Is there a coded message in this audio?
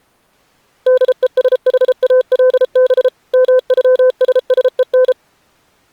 Yes: Morse code (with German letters) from 0.8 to 5.2 s, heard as a keyed tone, machine-sent, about 33 wpm, 510 Hz. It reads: DESHALB MÜSSEN